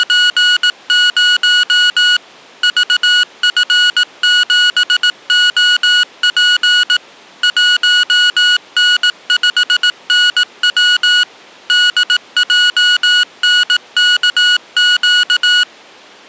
Morse code, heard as electronic beeps, machine-sent, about 18 wpm, 1460 Hz. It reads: … VF7OP 1N5NW DJNKQ